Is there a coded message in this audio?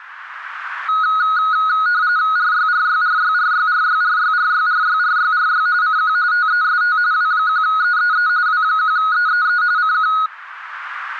Yes: RTTY (45.45 baud, 170 Hz shift) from 0.9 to 10.3 s, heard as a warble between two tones, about 1360 Hz centre. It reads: RYRYRYRYRYRYRYRYRYRY CQ TEST W1EEE W1EEE CQ